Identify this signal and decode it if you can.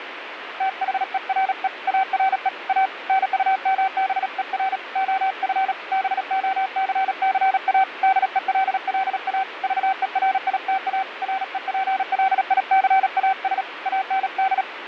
Morse code, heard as a keyed tone, hand-sent with a paddle, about 37 wpm, 770 Hz, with radio static and fading. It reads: THERE ARE A NUMBER OF BOCCA DELLA VERITA REPLICAS AND